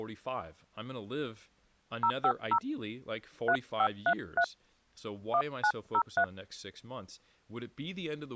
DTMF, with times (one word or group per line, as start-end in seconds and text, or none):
2.0-2.6 050
3.5-4.4 3533
5.3-6.2 1903